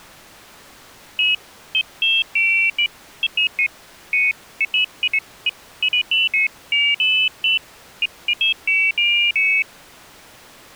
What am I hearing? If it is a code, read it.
Pairs of high tones at irregular times. There is no code.